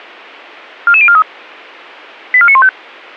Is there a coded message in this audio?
Yes: five-tone selective call (ZVEI) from 0.9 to 2.7 s, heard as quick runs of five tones, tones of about 70 ms, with a squelch burst at the end. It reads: 44043 84915